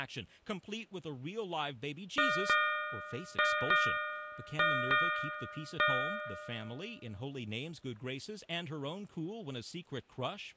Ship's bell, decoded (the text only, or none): 7